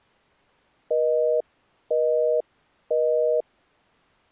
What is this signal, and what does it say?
Telephone call progress tone (North American plan), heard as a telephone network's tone, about 480, 620 Hz, 0.5 s on and 0.5 s off. Busy tone.